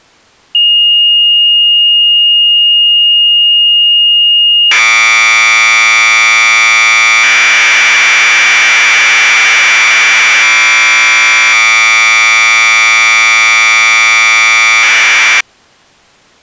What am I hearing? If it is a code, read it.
Commodore tape loading (standard loader), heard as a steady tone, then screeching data.